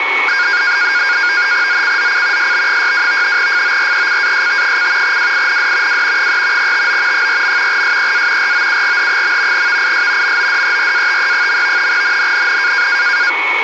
NAVTEX (SITOR-B), 100 baud, 170 Hz shift, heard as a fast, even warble, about 1500 Hz centre, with radio static and a steady whistle near 2220 Hz. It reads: ZCZC SB62 FORECAST: WIND W 3 TO 4. SEA ROUGH. VIS MODERATE. NNNN